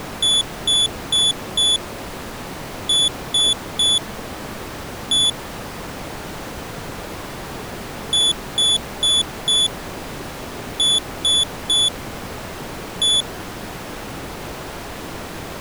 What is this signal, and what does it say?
Beep code, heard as a piezo beeper, played twice, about 3450 Hz. 4-3-1. In Phoenix BIOS tables: memory failure above the first 64 KB.